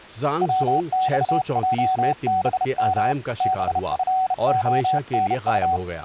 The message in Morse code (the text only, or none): WXJBM BFONU